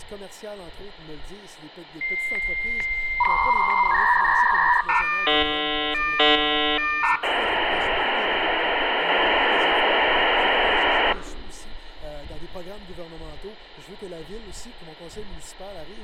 Dial-up modem handshake (V.34 or later), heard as a whistle, warbles, then hiss, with hum.